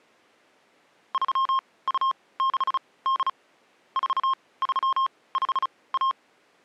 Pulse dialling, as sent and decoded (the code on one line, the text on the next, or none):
none